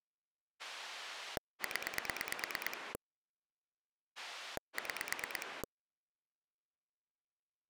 Pulse dialling, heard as a rotary dial, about 9 pulses a second. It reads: 0 6